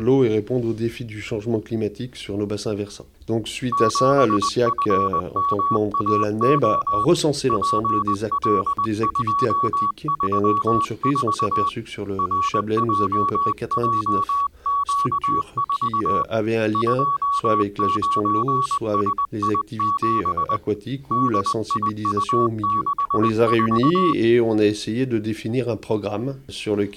Morse code, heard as a keyed tone, hand-sent with a paddle, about 20 wpm, 1130 Hz. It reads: 7FMAO PL234 RJJQ4 29SI7 DIU64